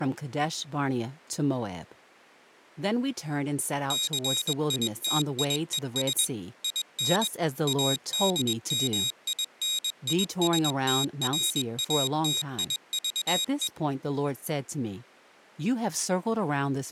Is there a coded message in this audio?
Yes: Morse code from 3.8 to 13.7 s, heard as a high beeper, machine-sent, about 21 wpm, 3800 Hz, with speech in English. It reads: CITIES IN ADMINISTRATIVE